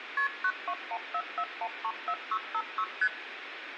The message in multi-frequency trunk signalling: KP 92144134656 ST

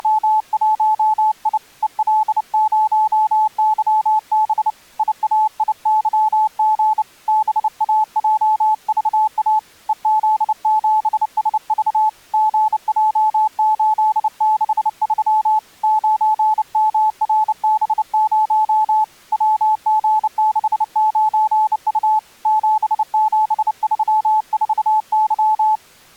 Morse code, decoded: … EL0YB IAIYG BAJVA EZ7SV GJ863 9MRB0 WG69U 7734Y

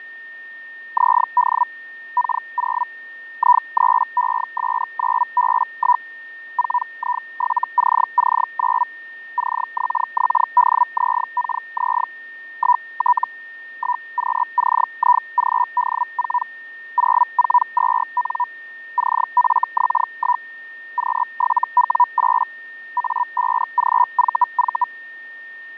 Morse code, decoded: none

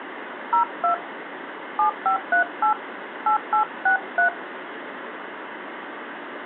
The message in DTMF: 02 7538 8863

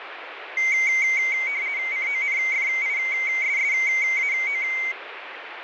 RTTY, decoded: CONFISSAO

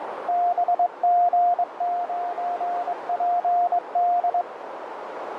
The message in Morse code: BG9PD

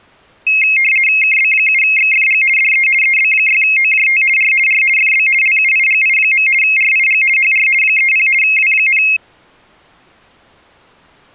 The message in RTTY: KB7XFG DE EB6OJT R R FB LUIGI. RIG HR 30 W,

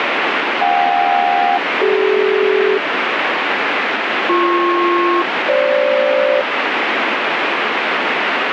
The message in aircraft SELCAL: JK-CD BP-FG

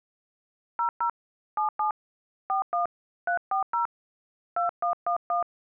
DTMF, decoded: 00 77 41 340 2111

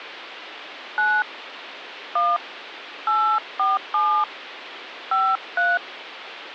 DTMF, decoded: 9 1 847 53

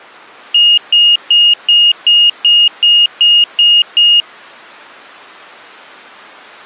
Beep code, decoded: 10 short

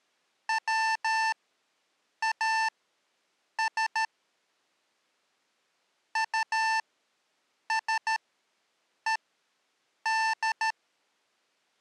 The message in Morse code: WAS USED

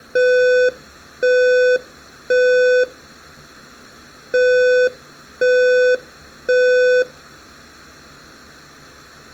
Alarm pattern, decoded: temporal three

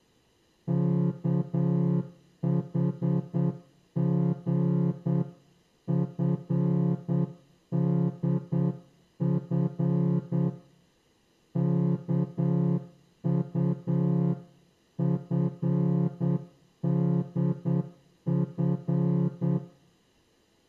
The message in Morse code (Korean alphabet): 웃는 이는

